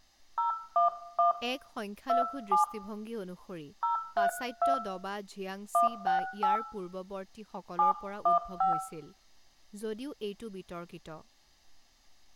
DTMF, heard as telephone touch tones, dialled by hand, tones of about 130 ms, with room echo and speech in Assamese. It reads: 011 27 032 168 715